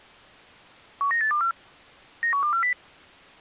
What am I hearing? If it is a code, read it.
Five-tone selective call (CCIR), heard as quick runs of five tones, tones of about 100 ms. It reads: 19824 91240